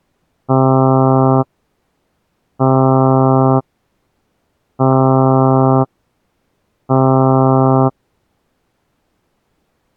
Ship horn signal, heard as a ship's horn, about 130 Hz. 4 short. At sea: a pilot vessel's identity signal in fog.